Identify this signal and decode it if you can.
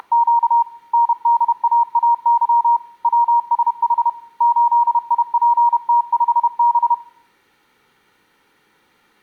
Morse code, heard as a keyed tone, hand-sent with a paddle, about 31 wpm, 940 Hz. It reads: … NDAAY WSH 8IPT5B